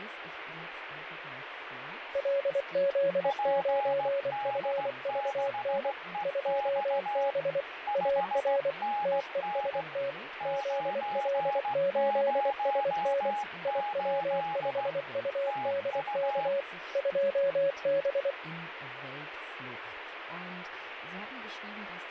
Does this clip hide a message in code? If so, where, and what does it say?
Yes: Morse code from 2.1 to 18.4 s, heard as two keyed tones, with radio static and speech in German. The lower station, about 24 wpm, 560 Hz: LZ9FVN 2B AR TEST ZL8SN IW5UDK 2B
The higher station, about 16 wpm, 830 Hz: PD6EX 5NN 908 TU